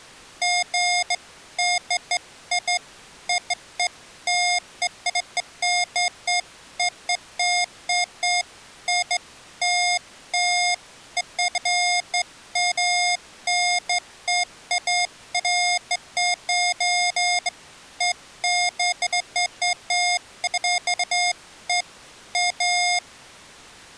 Beeps of irregular length. There is no code.